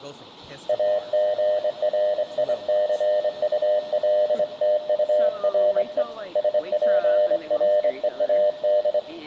Morse code, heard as a keyed tone, hand-sent with a straight key, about 25 wpm, 600 Hz, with room echo and speech in English. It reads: AGRICULTURE SPREAD